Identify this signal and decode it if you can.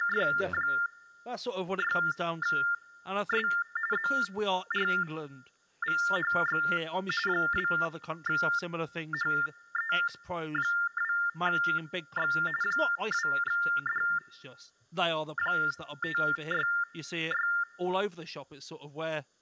TTY/TDD text telephone tones (45.45 baud Baudot), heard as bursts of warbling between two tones, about 400 Hz shift, 1600 Hz centre, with speech in English. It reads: … ZRVHX 2HE2X 2D566